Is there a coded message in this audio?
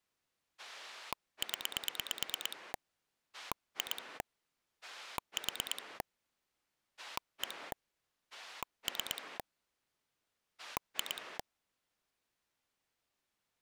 Yes: pulse dialling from 0.6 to 11.4 s, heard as a rotary dial, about 9 pulses a second. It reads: 0 2 4 1 3 2